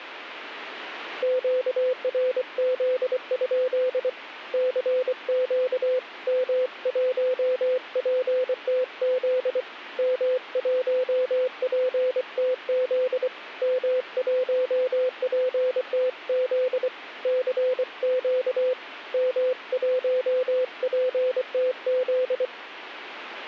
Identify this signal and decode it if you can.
Morse code, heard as a keyed tone, hand-sent with a paddle, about 24 wpm, 510 Hz. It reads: QRZ? CQ M1PTZ M1PTZ M1PTZ CQ M1PTZ